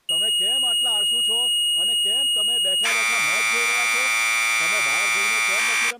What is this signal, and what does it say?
Commodore tape loading (standard loader), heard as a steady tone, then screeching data, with speech in Gujarati.